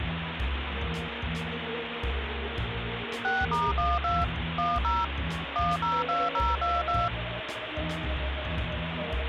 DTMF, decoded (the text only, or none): 6*12 10 102022